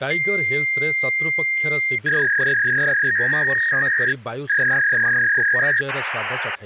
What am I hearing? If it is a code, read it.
Fax machine handshake, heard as a long tone, a warble and hiss, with hum and speech in Odia.